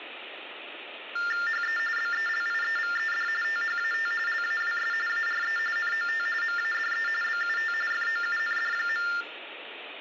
TTY/TDD text telephone tones (45.45 baud Baudot), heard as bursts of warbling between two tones, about 400 Hz shift, 1600 Hz centre, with phone line noise and room echo. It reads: HE BELIEVED THAT LAWS ARE NOT MADE BUT FOUND.